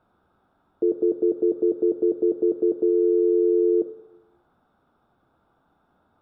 Telephone call progress tone (North American plan), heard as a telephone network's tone, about 350, 440 Hz, 0.1 s on and 0.1 s off, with room echo. Stutter dial tone.